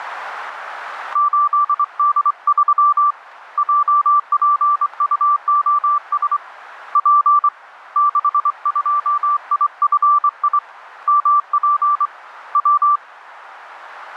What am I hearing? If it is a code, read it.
Morse code, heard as a keyed tone, hand-sent with a straight key, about 24 wpm, 1170 Hz, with radio static. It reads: 8D3 JPUOS P 62IFI MP W